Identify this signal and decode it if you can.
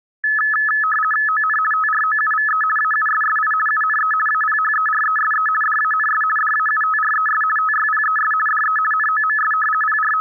RTTY (50 baud, 450 Hz shift), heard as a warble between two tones, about 1500 Hz centre. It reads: ON TROUVE AUSSI UNE APHERESE DANS DAUTRES TYPES DE NOMS …